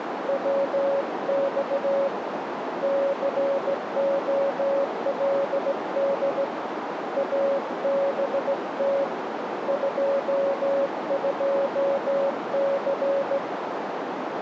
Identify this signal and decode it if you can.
Morse code, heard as a keyed tone, hand-sent with a straight key, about 16 wpm, 550 Hz, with radio static and a narrow filter. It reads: WX COLD ABT 22C